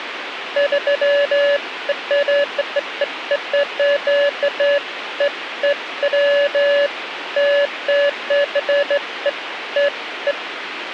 Beeps of irregular length, with radio hiss. There is no code.